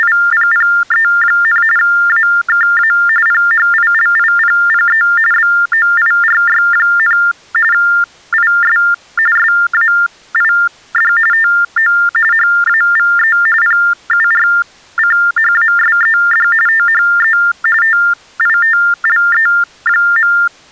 TTY/TDD text telephone tones (45.45 baud Baudot), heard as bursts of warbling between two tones, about 400 Hz shift, 1600 Hz centre. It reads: … AKA PHILIPPE BOIRY, IS SAID TO HAVE PURCHASED THE TITLE.